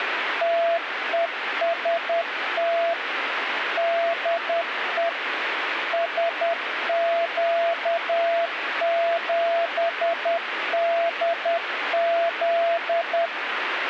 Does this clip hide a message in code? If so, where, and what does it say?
Yes: Morse code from 0.4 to 13.3 s, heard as a keyed tone, machine-sent, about 10 wpm, 680 Hz, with radio static. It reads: TEST DE SQ7DZ